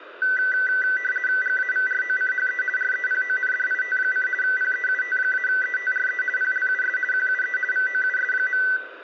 RTTY (50 baud, 450 Hz shift), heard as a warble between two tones, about 1750 Hz centre, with radio static. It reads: GAVROCHE REPONDIT: PEUT-ETRE PLUS QUE VOUS.